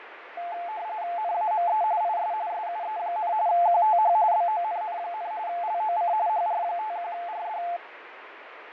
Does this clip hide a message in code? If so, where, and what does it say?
Yes: RTTY (45.45 baud, 170 Hz shift) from 0.4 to 7.8 s, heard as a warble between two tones, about 780 Hz centre, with radio static and fading. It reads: NAME IS SUE, QTH BONN, LOC HR51RD